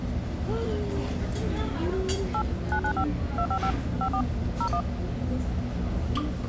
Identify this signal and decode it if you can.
DTMF, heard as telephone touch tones, dialled by machine, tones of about 80 ms, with the noise of a restaurant. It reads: 8 995 255 54 01